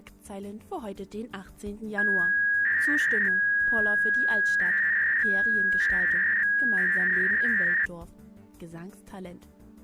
300-baud modem data (V.21 tones), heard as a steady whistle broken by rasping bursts, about 300 baud, 200 Hz shift.